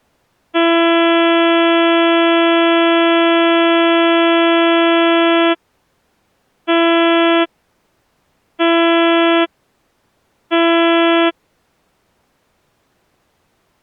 Ship horn signal, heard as a ship's horn, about 340 Hz. 1 long, 3 short. At sea: a vessel under tow in fog.